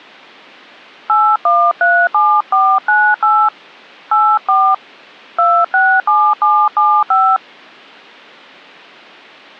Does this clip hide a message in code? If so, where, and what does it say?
Yes: DTMF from 1.1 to 7.4 s, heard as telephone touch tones, dialled by hand, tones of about 260 ms. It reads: 8137498 84 267775